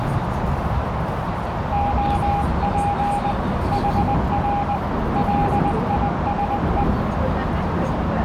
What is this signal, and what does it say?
Morse code, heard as a keyed tone, hand-sent with a paddle, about 20 wpm, 810 Hz, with heavy radio static, a narrow filter and the noise inside a subway train. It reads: OP HR LISE